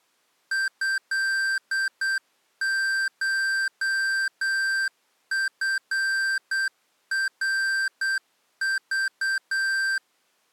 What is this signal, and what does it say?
Morse code (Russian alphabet), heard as electronic beeps, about 8 wpm, 1550 Hz. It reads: ЭШФРЖ